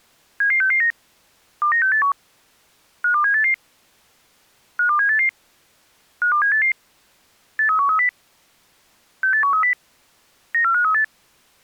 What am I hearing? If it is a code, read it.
Five-tone selective call (CCIR), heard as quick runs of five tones, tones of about 100 ms. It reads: 77669 29681 52788 52788 52788 83130 68130 94538